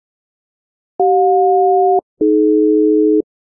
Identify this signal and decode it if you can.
Aircraft SELCAL, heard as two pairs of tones. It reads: CJ-AD